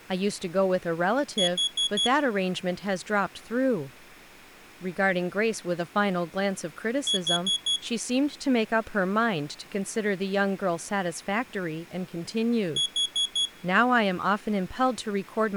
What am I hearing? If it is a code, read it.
Alarm pattern, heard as an alarm's beeps, played three times, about 3350 Hz, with room echo and speech in English. Temporal four. Carbon monoxide.